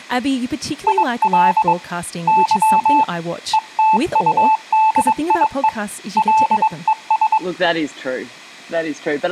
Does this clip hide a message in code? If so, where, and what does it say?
Yes: Morse code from 0.8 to 7.4 s, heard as a keyed tone, hand-sent with a paddle, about 22 wpm, 880 Hz, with room echo and speech in English. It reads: IL Y ETUDIE LES